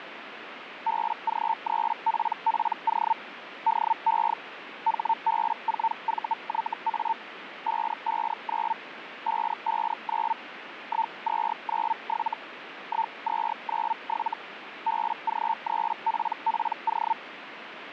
Hellschreiber (Feld-Hell, 122.5 baud), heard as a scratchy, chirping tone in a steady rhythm, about 900 Hz, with radio static. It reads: BG3PPO DE HB4VYA 559 559 1297 1297 BG3PPO